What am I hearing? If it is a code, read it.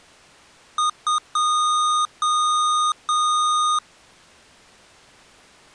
Beep code, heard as beeps from a small speaker, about 1230 Hz. 2 short, 3 long.